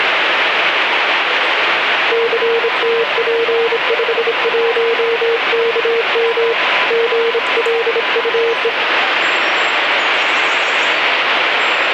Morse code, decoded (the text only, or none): CTP51KM GLUE